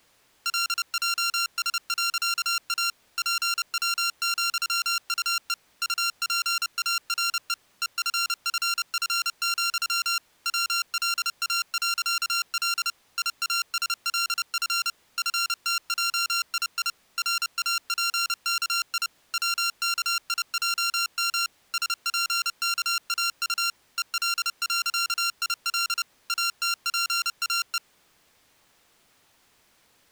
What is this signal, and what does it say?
Morse code, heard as electronic beeps, machine-sent, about 30 wpm, 1380 Hz. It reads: LJS.A PW,UE UPARE EFFF, WLA.L IASLF FTJII RAPKI WKIJM SPKAU EL.IL ATPAE